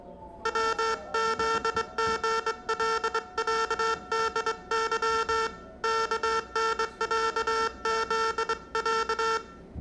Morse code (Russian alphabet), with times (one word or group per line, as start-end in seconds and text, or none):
0.5-5.5 ВЗГЛЯДЫ
5.8-9.4 КНЯЗЯ